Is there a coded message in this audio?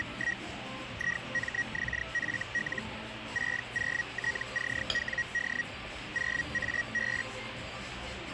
Yes: Hellschreiber (Feld-Hell, 122.5 baud) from 0.0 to 7.2 s, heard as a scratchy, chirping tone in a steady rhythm, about 1900 Hz, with radio static and the noise of a cafe. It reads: … IMXFL 60TCWD 0AB